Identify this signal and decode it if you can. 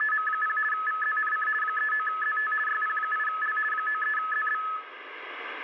RTTY (50 baud, 450 Hz shift), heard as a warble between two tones, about 1500 Hz centre, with radio static and room echo. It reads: … VZNC 39ZT YP8L 93ZB